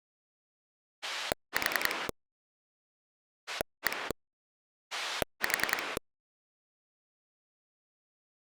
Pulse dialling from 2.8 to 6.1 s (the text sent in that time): 1 4